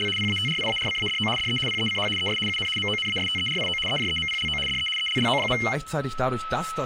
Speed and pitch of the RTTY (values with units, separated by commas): 75 baud, 850 Hz shift, 2550 Hz centre